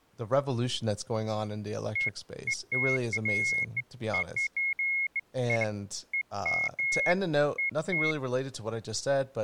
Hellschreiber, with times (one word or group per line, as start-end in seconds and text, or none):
none